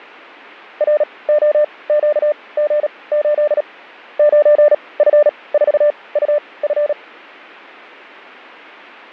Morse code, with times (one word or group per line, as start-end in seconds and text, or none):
0.8-3.6 ROQG8
4.2-6.9 9F4UF